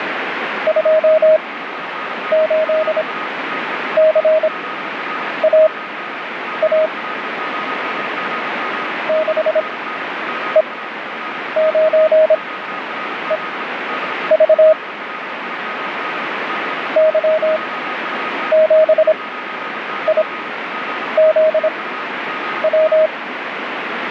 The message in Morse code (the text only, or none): 28CAA 6E9EV Y7IZW